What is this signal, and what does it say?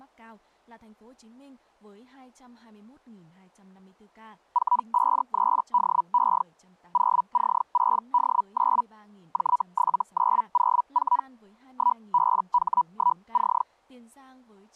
Hellschreiber (Feld-Hell, 122.5 baud), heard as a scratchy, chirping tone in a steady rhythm, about 980 Hz, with speech in Vietnamese. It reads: 453DE 0C6D9 J7904 1BH1C